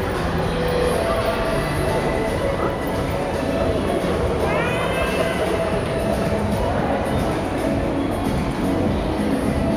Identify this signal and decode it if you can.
The noise of a crowd indoors. There is no code.